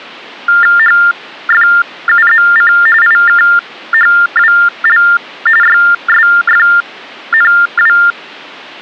TTY/TDD text telephone tones (45.45 baud Baudot), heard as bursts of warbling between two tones, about 400 Hz shift, 1600 Hz centre. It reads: HFUZC IKHWL YSFNW